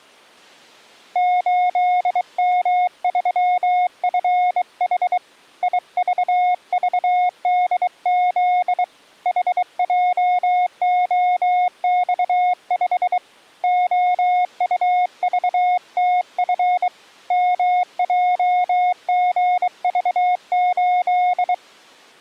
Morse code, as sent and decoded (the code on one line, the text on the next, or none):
---.. -- ...-- ..-. .... / .. ...- ...- -.. --.. / .... .--- --- -..- ..... / --- ..- ...- - ..-. / -- .--- --. ...- ---..
8M3FH IVVDZ HJOX5 OUVTF MJGV8